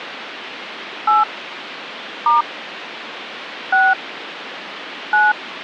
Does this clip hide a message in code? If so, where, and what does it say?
Yes: DTMF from 1.1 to 5.3 s, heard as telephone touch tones, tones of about 170 ms, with phone line noise. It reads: 8 * 6 9